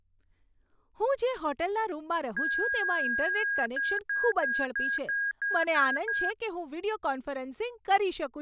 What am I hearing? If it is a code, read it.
Beep code, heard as beeps from a small speaker, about 1650 Hz, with speech in Gujarati. 1 long, 8 short. In AMI BIOS tables: display or retrace test failure.